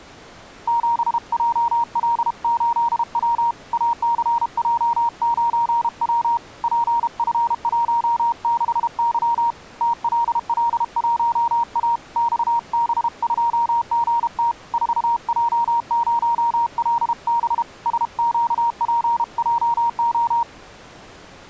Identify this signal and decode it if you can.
Morse code, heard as a keyed tone, hand-sent with a paddle, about 32 wpm, 940 Hz. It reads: 7JL8W ACJ9W PF16Y TLL1A XB2GT 4J0LB SQPJO